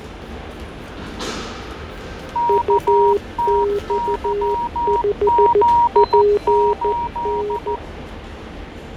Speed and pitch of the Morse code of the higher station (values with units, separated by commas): 14 wpm, 950 Hz